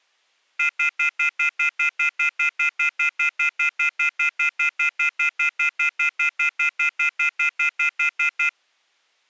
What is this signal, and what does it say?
Telephone call progress tone (North American plan), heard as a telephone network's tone, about 1400, 2050, 2450, 2600 Hz, 0.1 s on and 0.1 s off. Off-hook warning tone.